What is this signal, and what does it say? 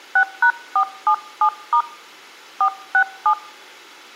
DTMF, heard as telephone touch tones, dialled by hand, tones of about 80 ms. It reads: 6#477* 467